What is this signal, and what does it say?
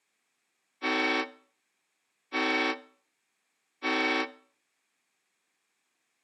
Train horn signal, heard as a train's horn. 3 short. On North American railways: when stopped, the train will back up.